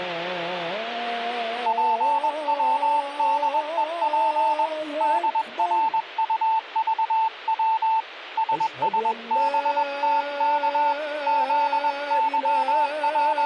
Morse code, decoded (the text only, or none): PWDEP DRUVW SSBTK …